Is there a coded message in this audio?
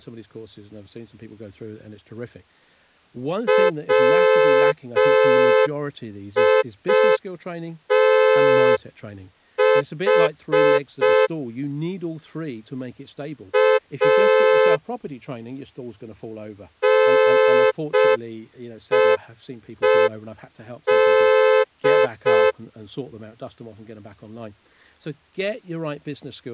Yes: Morse code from 3.4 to 22.6 s, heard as a horn, hand-sent with a straight key, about 5 wpm, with speech in English. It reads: WITH A NEED